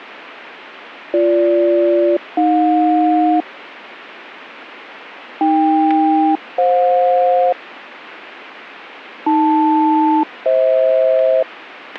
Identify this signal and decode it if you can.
Aircraft SELCAL, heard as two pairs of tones, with static crashes. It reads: BG-AJ AK-FJ AL-FH